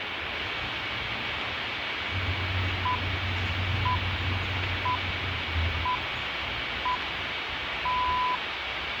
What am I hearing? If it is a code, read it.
Radio time signal (six pips, as the Greenwich Time Signal), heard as pips, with radio static, a steady whistle near 2260 Hz and the noise of a park.